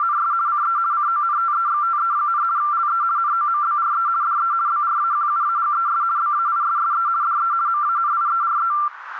RTTY (50 baud, 170 Hz shift), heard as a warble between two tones, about 1270 Hz centre, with radio static. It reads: … CE CONTEXTE, LE NOMBRE DE BRAQUAGES BAISSE DE MANIERE